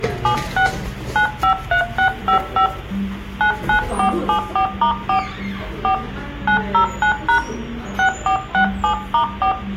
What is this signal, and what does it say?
DTMF, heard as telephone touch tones, dialled by hand, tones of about 100 ms, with room echo and the noise of a cafe. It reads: 76 953655 99474*4 4 909# 6467*4